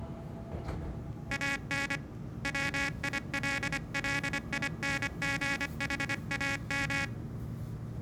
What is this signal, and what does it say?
Morse code, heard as a buzzer, hand-sent with a paddle, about 25 wpm, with the noise inside a subway train. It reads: AN WILLINGHAM